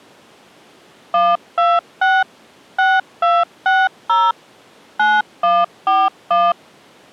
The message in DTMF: 126 6260 9141

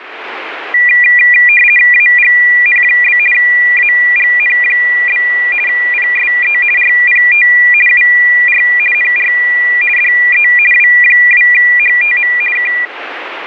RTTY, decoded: AGN? AGN? PSE RPT UR NR DE W2HTM K

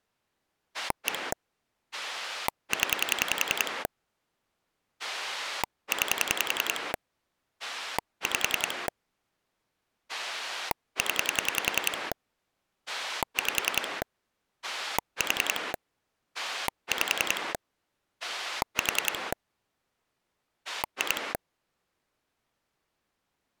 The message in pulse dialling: 1 0 9 5 0 5 4 5 4 2

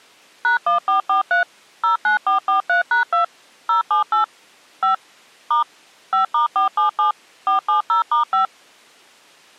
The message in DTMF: #1443 09443#2 078 5 * 5*477 470*5

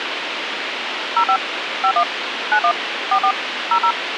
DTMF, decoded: 05 51 91 44 00

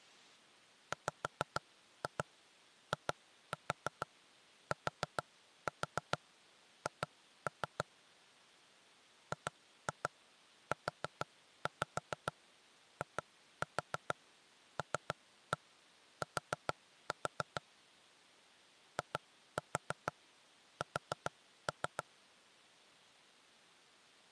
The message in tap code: WITH GUILT IS

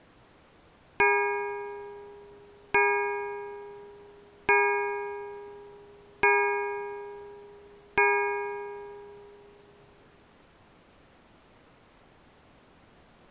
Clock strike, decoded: 5

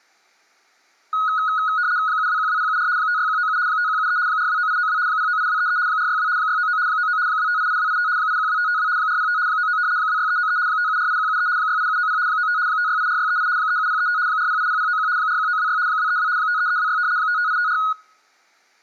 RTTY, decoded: 7212074 56197 5173 429892 098233 462 699 99 2588285 812552 405 99 26393 5748173 68790 95 5684638 37035 4080091 41926 232 53326 55854

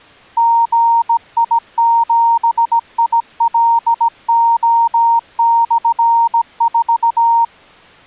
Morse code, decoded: GI7ILO/4

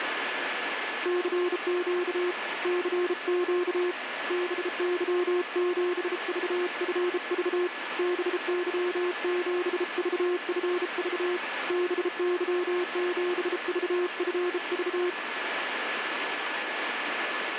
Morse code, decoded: CQ CQ BY7VFV BY7VFV BY7VFV

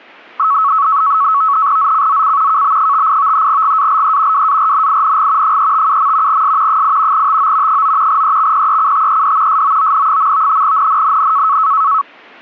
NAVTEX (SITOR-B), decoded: ZCZC KB58 GALE WARNING 357. S 8 TO 9 EXPECTED SOON. NNNN

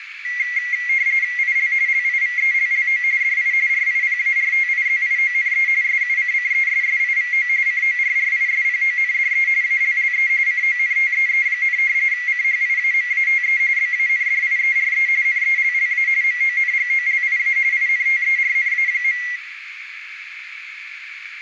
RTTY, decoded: IL LIVELLO DI RIPARTIZIONE SUCCESSIVO CORRISPONDE ALLE CONTEE, CHIAMATE BANDIERE NELLA MONGOLIA INTERNA.

